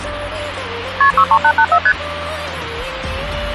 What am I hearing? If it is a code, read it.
Multi-frequency trunk signalling (R1, as on North American trunks), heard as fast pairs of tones, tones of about 70 ms, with phone line noise. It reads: KP 63884 ST